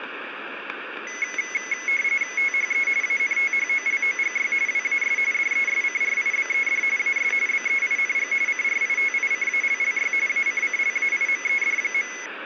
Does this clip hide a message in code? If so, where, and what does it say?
Yes: RTTY (45.45 baud, 170 Hz shift) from 1.1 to 12.3 s, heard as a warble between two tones, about 2100 Hz centre, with radio static, static crashes and room echo. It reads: THE ANTHOLOGY WAS DESCRIBED AS BEING CRITICALLY ACCLAIMED.